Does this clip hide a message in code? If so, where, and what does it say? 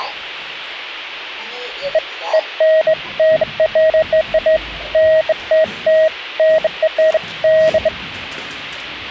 No, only beeps of irregular length, with the noise inside a lift.